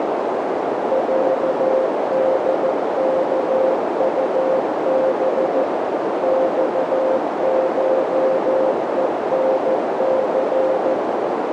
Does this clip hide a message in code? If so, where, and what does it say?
Yes: Morse code (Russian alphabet) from 0.9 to 11.0 s, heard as a keyed tone, machine-sent, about 14 wpm, 530 Hz, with heavy radio static and a narrow filter. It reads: ЯДКУБ ЬШЕНЦ